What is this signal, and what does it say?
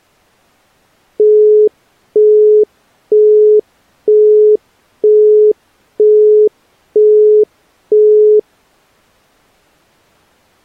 Telephone call progress tone (single-tone plan, as in Europe, Japan and elsewhere), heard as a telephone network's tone, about 420 Hz, 0.48 s on and 0.48 s off. Busy tone.